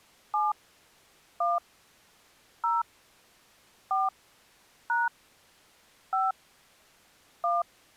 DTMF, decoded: 7 1 0 4 # 5 1

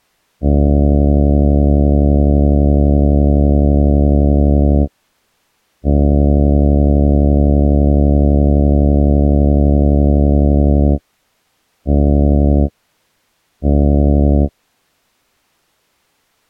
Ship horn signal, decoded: 2 long, 2 short

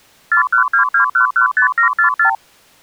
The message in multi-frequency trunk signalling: 4122115744

